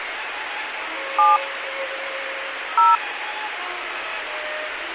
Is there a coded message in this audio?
Yes: DTMF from 1.2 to 3.0 s, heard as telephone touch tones, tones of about 180 ms, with radio hiss and a squelch burst at the end. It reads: 7 0